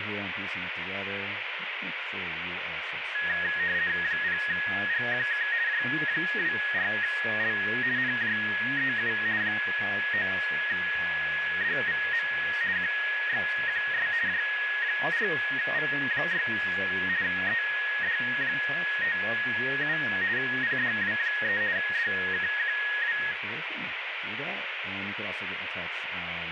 RTTY (50 baud, 170 Hz shift), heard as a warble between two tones, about 1750 Hz centre, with radio static and speech in English. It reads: 0GQK J24L NJEU 9DVM QXQS J4V6 ED57 PDW3 DKQW